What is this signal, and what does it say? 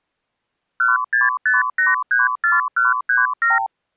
Multi-frequency trunk signalling (R2, with the far end's replies), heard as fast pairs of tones, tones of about 160 ms. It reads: 165834137